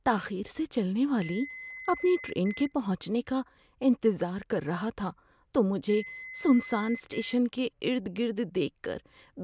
Beep code, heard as beeps from a small speaker, played twice, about 2050 Hz, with speech in Urdu. 1 long, 1 short. In IBM BIOS tables: system board problem.